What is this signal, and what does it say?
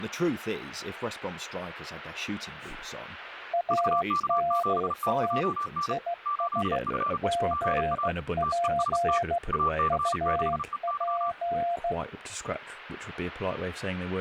Morse code, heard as two keyed tones, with speech in English. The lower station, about 15 wpm, 690 Hz: ANT IS GP UP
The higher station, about 35 wpm, 1160 Hz: VK7TJN 8F GA TEST AC6EY